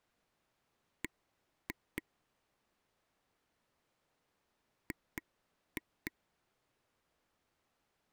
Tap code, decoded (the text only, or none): B G